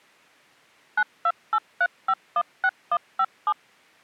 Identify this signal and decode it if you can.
DTMF, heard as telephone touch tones, dialled by machine, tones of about 60 ms. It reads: 9283516157